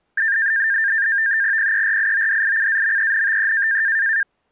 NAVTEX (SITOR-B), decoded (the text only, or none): PERIODICAMENTE